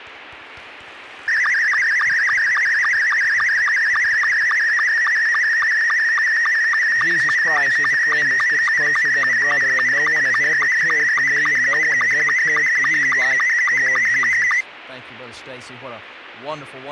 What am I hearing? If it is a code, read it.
SSTV (slow-scan television), Scottie S2, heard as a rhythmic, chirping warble.